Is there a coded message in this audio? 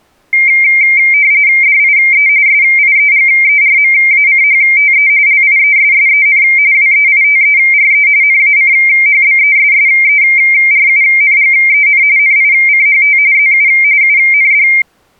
Yes: RTTY (45.45 baud, 170 Hz shift) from 0.3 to 14.8 s, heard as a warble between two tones, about 2200 Hz centre. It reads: DIE SIEGERMACHTE LIESSEN WEITERE NACHBESSERUNGEN NICHT ZU UND